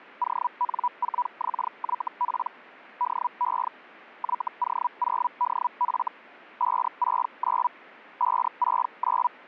Hellschreiber (Feld-Hell, 122.5 baud), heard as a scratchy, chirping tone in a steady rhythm, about 980 Hz. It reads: ON4XYP DE YO0DF 569 569